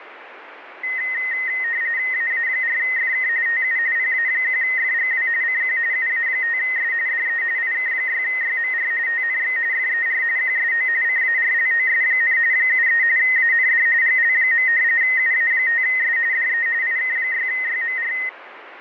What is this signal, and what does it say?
RTTY (45.45 baud, 170 Hz shift), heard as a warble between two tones, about 1950 Hz centre, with radio static. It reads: AA4FK TU PA1FGW CQ UA5S DE IK6YMR TNX FER QSO CARLOS, 73 AND GL. UA5S DE IK6YMR